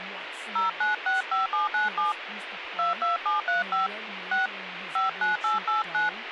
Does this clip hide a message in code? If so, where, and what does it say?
Yes: DTMF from 0.6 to 6.1 s, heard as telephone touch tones, dialled by hand, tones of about 140 ms, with radio hiss and speech in English. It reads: 0965797 22735 6 59889